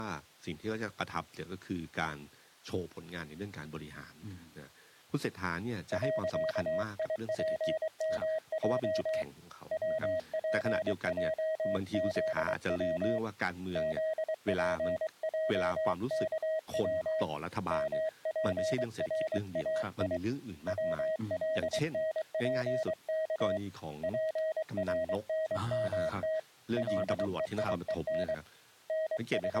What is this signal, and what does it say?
Morse code, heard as a keyed tone, hand-sent with a paddle, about 23 wpm, 630 Hz, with speech in Thai. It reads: .IPMJ WPJZW ZPJKW MPRAI WLNPK PRNMT LEIEN …